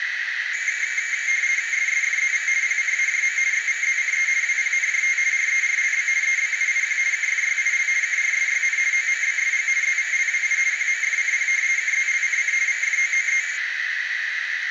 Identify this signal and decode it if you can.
RTTY (50 baud, 170 Hz shift), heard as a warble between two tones, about 2200 Hz centre, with radio static and a narrow filter. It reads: SSFZV PCAJM XVZCE WPNJT RERLB EBUIQ KFYIL KRSYN OMBSG ZVLWI QMFCP KZLCC VFOOE